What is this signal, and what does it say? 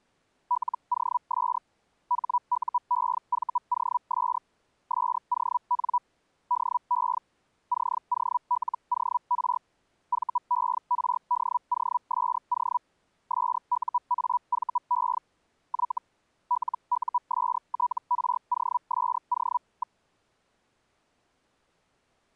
Hellschreiber (Feld-Hell, 122.5 baud), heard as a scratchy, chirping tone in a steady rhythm, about 980 Hz. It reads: LOS HUEVOS SON DE COLOR VERDOSO SUAVE Y LUSTROSO.